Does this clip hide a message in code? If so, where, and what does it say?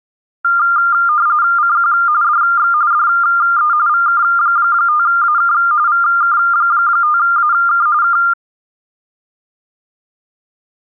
Yes: RTTY (45.45 baud, 170 Hz shift) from 0.4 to 8.3 s, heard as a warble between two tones, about 1300 Hz centre. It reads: CQ DX DE VK5AK VK5AK K